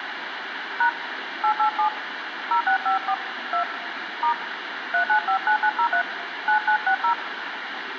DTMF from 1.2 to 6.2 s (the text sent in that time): 887 0654 2 * 3959903